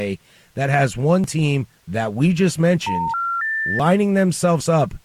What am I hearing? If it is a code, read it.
Telephone call progress tone (North American plan), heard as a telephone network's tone, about 910, 1370, 1800 Hz, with speech in English. Special information tone.